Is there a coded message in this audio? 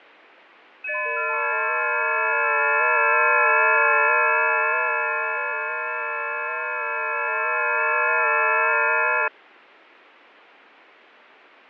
Yes: FT8 (several signals at once) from 0.8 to 9.3 s, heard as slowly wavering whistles, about 6.25 baud, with fading.